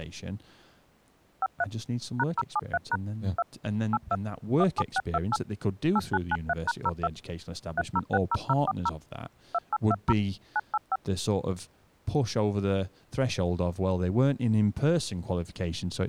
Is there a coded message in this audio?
Yes: DTMF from 1.4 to 11.0 s, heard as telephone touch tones, dialled by machine, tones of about 40 ms, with speech in English. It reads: 53 #073# 2 82 17628 8993#02 3060040 2820 985